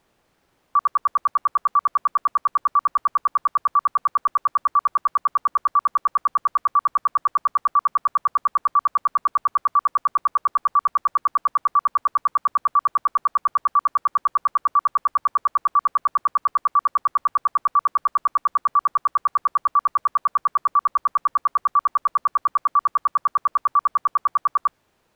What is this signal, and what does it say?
Radio time signal (RWM, Moscow), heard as ten pulses a second.